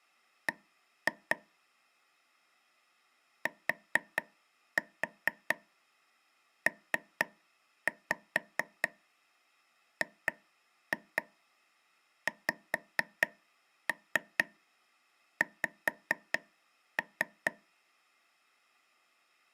Tap code, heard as taps on a table, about 4 knocks a second. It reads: B TPGXX